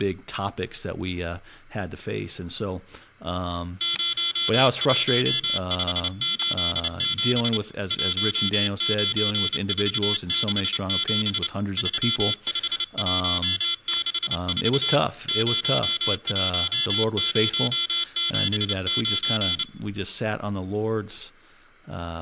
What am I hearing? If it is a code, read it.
Morse code, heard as a high beeper, hand-sent with a paddle, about 29 wpm, 3400 Hz, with room echo and speech in English. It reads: 01587 19467 35164 01079